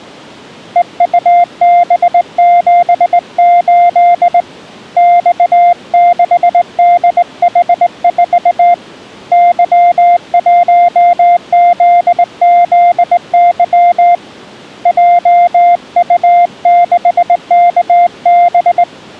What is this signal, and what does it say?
Morse code, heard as a keyed tone, hand-sent with a straight key, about 19 wpm, 700 Hz. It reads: EUB78 X6DH4 Y1ZZY JU6KB